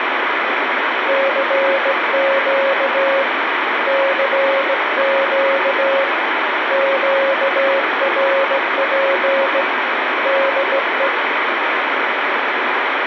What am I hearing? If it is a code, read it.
Morse code, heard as a keyed tone, hand-sent with a straight key, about 17 wpm, 550 Hz, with heavy radio static. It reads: CQ CQ QRP DE